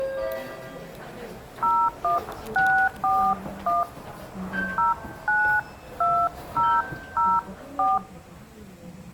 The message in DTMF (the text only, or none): 01641 092004